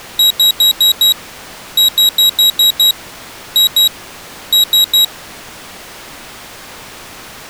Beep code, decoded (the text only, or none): 5-6-2-3